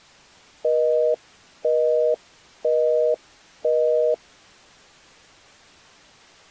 Telephone call progress tone (North American plan), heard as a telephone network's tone, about 480, 620 Hz, 0.5 s on and 0.5 s off. Busy tone.